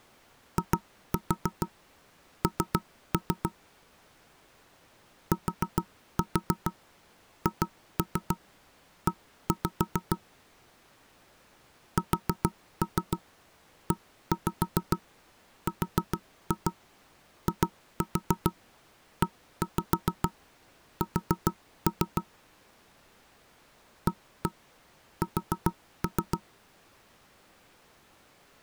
Tap code, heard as knocks on wood, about 7 knocks a second. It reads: IN THE SERIES AS